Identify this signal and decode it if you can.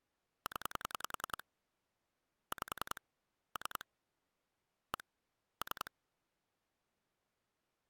Pulse dialling, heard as clicks on a phone line, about 10 pulses a second. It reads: 0 5 3 1 3